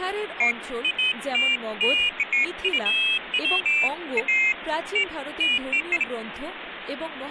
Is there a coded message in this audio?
No, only pairs of high tones at irregular times, with phone line noise and speech in Bangla.